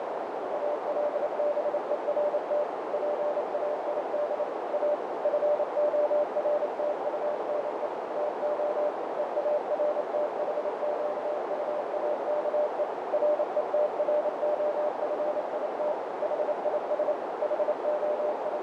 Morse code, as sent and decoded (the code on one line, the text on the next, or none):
.- .-.. -... . .-. - / .--. .- .. -.. / .- / ..-. --- .-. - ..- -. . / - --- / . .- .-. - .... --.- ..- .- -.- . / .-. . - .-. --- ..-. .. - / .... .. ... / …
ALBERT PAID A FORTUNE TO EARTHQUAKE RETROFIT HIS …